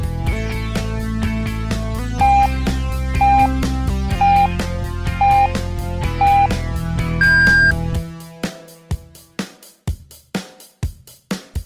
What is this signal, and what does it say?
Radio time signal (five pips and a higher one, as on Chinese radio), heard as pips.